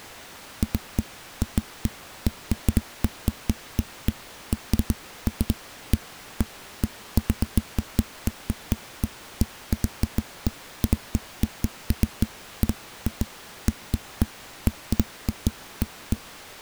Irregular knocks on a wall. There is no code.